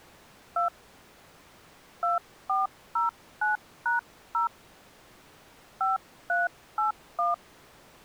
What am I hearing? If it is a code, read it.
DTMF, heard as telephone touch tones, dialled by hand, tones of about 150 ms. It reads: 2 2409#0 5381